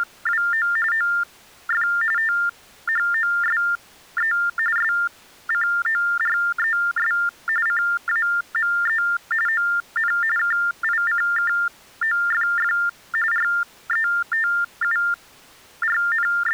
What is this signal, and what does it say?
TTY/TDD text telephone tones (45.45 baud Baudot), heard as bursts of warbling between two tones, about 400 Hz shift, 1600 Hz centre. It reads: … OF THOSE SCORES CAME ON KICKOFF …